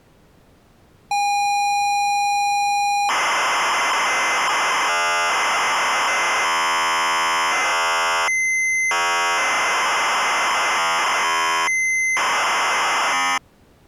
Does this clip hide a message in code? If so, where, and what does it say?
Yes: ZX Spectrum tape loading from 1.1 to 13.4 s, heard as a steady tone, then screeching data.